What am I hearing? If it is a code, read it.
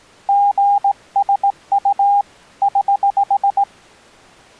Morse code, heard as a keyed tone, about 18 wpm, 810 Hz. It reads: GSU <HH>